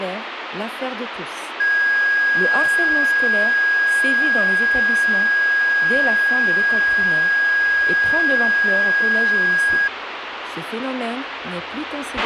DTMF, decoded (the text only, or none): none